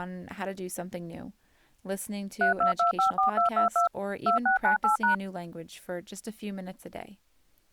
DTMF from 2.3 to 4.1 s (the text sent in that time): 32254222